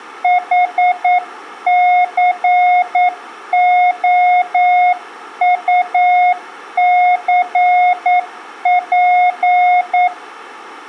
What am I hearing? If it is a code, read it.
Morse code, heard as a keyed tone, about 9 wpm, 720 Hz, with room echo. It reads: HCOUCP